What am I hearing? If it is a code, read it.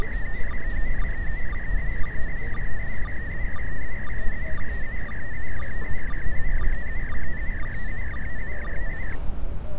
SSTV (slow-scan television), PD 120, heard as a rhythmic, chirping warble, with street noise.